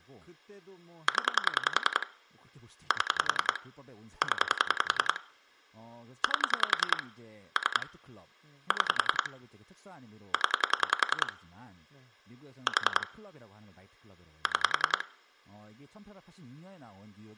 Pulse dialling, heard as clicks on a phone line, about 10 pulses a second, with room echo and speech in Korean. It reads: 0 7 0 8 3 6 0 4 6